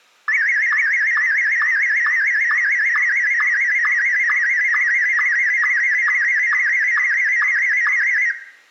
SSTV (slow-scan television), Martin M1, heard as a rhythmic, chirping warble, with room echo.